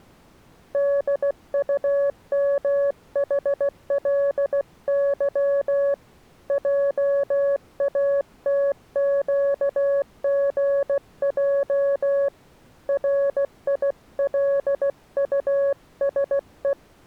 Morse code, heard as a keyed tone, hand-sent with a paddle, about 16 wpm, 560 Hz. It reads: DUMHLY JATQGJ RILUSE